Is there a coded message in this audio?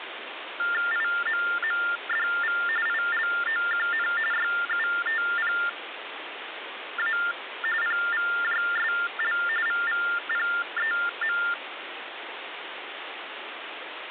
Yes: TTY/TDD text telephone tones (45.45 baud Baudot) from 0.6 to 11.5 s, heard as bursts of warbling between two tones, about 400 Hz shift, 1600 Hz centre, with phone line noise. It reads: IMMDV ILOQN YUTPA PVJSL VVPEM